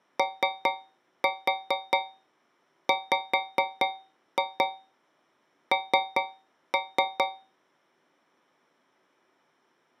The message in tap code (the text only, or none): OWN